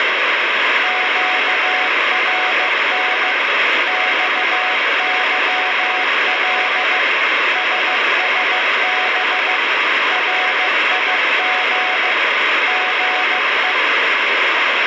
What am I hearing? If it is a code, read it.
Morse code, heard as a keyed tone, machine-sent, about 15 wpm, 740 Hz, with heavy radio static. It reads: QRN XYL SSB RIG GE